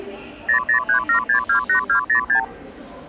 Multi-frequency trunk signalling (R2, with the far end's replies), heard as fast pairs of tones, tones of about 100 ms, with the noise of a subway station. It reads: 0037628206